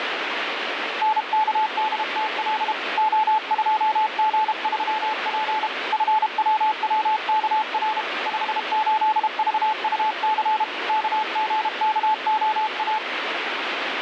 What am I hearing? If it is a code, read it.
Morse code, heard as a keyed tone, hand-sent with a paddle, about 32 wpm, 870 Hz, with radio static. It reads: NKDTL O2G3P FWWKR 58VUC KGKOA